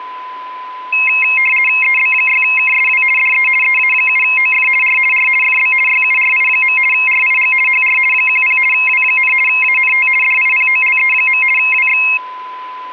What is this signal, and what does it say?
RTTY (50 baud, 450 Hz shift), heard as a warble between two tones, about 2350 Hz centre, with a steady whistle near 1010 Hz. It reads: EB6KSW DE EA7OF R R FB YURI. RIG HR 10 W, ANT DIPOLE. WX